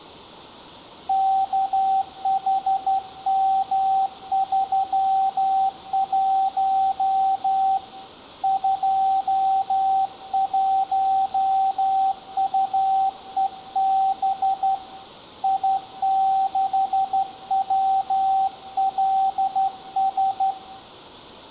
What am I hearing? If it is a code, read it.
Morse code, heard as a keyed tone, hand-sent with a straight key, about 12 wpm, 770 Hz, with room echo. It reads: KHM31 21UEB I6WLS